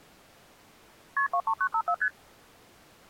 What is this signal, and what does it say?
Multi-frequency trunk signalling (R1, as on North American trunks), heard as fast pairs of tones, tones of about 70 ms. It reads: KP 23954 ST